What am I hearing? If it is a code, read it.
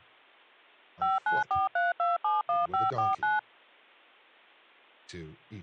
DTMF, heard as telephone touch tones, dialled by machine, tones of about 170 ms, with speech in English. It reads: 5943271549